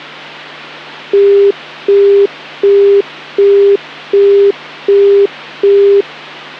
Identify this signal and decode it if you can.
Telephone call progress tone (as in the UK, Australia and similar networks), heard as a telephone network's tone, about 400 Hz, 0.375 s on and 0.375 s off, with hum. Busy tone.